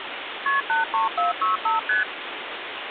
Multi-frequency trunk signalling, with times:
0.5-0.6 KP
0.7-1.8 83465
1.9-2.0 ST

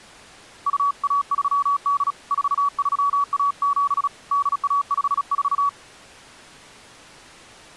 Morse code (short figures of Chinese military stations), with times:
0.7-2.1 2138
2.3-4.1 4317
4.3-5.7 8154

